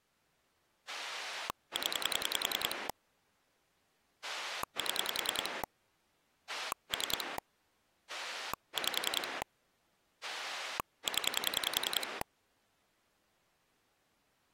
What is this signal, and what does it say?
Pulse dialling, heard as a rotary dial, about 10 pulses a second. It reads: 0 7 3 5 0